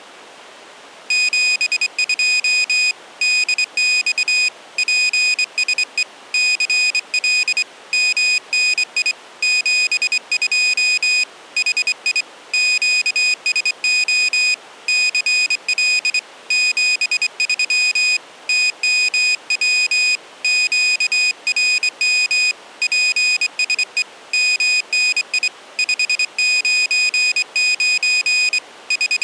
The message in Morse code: 72 DX PSE CL MNI 72 HI QSO CL 73 TMW QRM PSE MNI 599 …

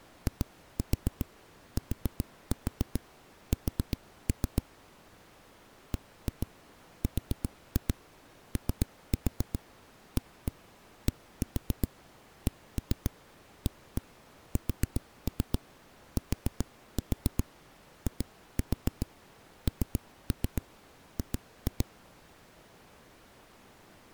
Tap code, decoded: ITS BROADCASTING

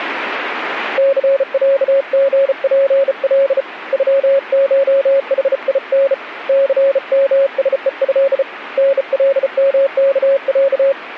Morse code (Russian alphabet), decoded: ЦЯГПЛ ЮШХИН ЦМСЕЭ НЛМКЯ

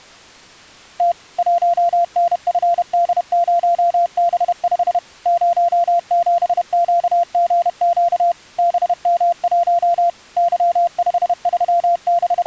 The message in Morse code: T 1NFD0B5 07QGQ BM1 …

